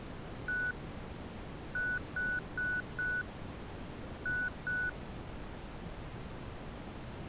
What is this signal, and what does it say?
Beep code, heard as beeps from a small speaker, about 1480 Hz. 1-4-2. In Phoenix BIOS tables: parity failure in the first 64 KB of memory.